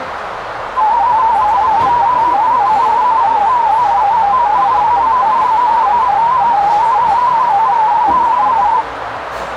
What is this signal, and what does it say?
Multi-tone FSK (Olivia or MFSK type), about 250 Hz wide, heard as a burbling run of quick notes, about 31.25 baud, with radio static, a narrow filter and the noise of a cafe.